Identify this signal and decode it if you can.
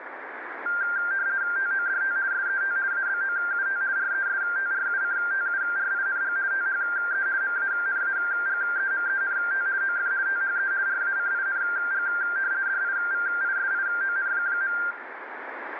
RTTY (50 baud, 170 Hz shift), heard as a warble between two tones, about 1490 Hz centre, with radio static and room echo. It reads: TODT SET ABOUT RESTRUCTURING THE MANAGEMENT OF THE RACING DIVISION.